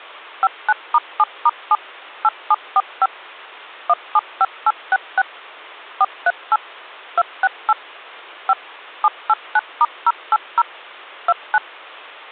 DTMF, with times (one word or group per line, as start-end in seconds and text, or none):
0.4-1.8 59*7*7
2.2-3.1 8745
3.9-5.2 175866
6.0-6.6 438
7.2-7.7 268
8.5-8.5 5
9.0-10.6 789*080
11.3-11.6 29